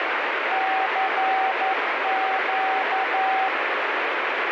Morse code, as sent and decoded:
-.-. --.-
CQ

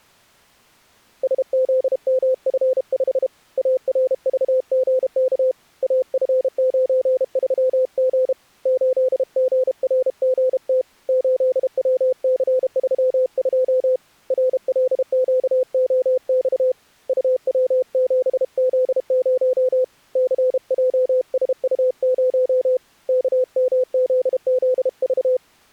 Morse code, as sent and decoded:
... --.. -- ..-. ..... / .- .-. ...- --. -.- / .- ..-. ----. ...-- --. / ---.. --. .-. --. - / ---.. .-- -.-. ...-- ..--- / .-. .-.. --.- --- -..- / ..- .-- --... --.. ----- / -.-. .--- ... ..- ----- / -.- -- --.. --.. ...-
SZMF5 ARVGK AF93G 8GRGT 8WC32 RLQOX UW7Z0 CJSU0 KMZZV

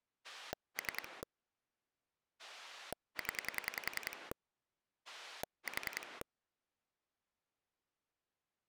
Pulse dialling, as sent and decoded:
3 / 10 / 4
3 0 4

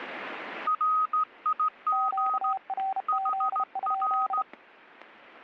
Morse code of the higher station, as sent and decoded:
.-. .. --. / .... .-.
RIG HR

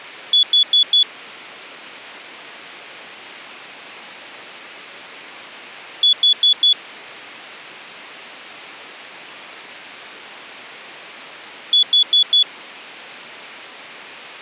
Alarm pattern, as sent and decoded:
4 beeps and a pause
temporal four

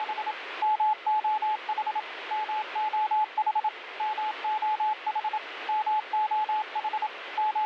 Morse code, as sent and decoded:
… / -- --- .... / -- --- .... / -- --- .... / -- --- .... / …
… MOH MOH MOH MOH …

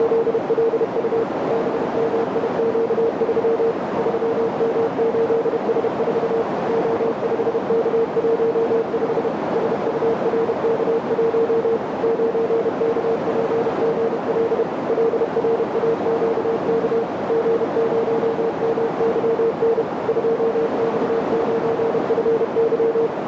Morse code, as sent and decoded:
… / -... -- .. --.- ...-- / ...-- -- ---.. ... ....- / --- ..... -.- .---- ..... / ... ..- .-. -.- .---- / ----. -.- .--. --. .-.. / .-.. .-. .- --.- -.- / --. ----- -- -.-- -. / ..--- -..- ----. ..-. -.--
… BMIQ3 3M8S4 O5K15 SURK1 9KPGL LRAQK G0MYN 2X9FY

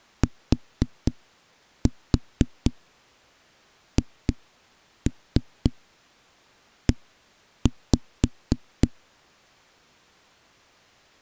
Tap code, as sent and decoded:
4-4 2-3 1-5
THE

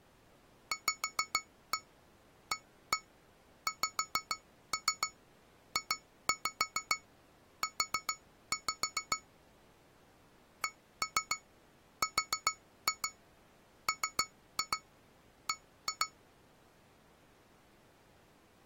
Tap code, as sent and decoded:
5-1 1-1 5-3 2-5 4-5 / 1-3 4-2 3-2 1-2
VAXJU CRMB

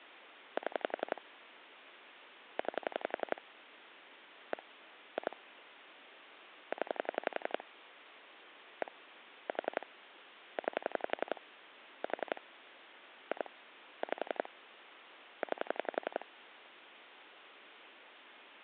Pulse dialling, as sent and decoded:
7 / 9 / 1 / 2 / 10 / 1 / 4 / 9 / 4 / 2 / 5 / 9
7 9 1 2 0 1 4 9 4 2 5 9

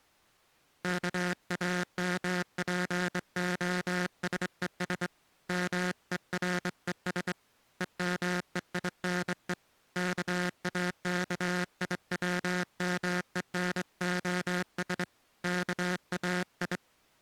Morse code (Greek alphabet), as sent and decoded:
-.- .- -- .--. --- ... . ... / -- . .-. . ... / . -- . .. -. . / -.- .- -.- .. .-- -- . -. --- ... / -.- .- ..
ΚΑΜΠΟΣΕΣ ΜΕΡΕΣ ΕΜΕΙΝΕ ΚΑΚΙΩΜΕΝΟΣ ΚΑΙ

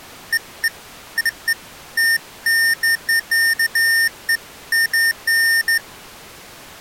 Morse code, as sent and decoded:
none

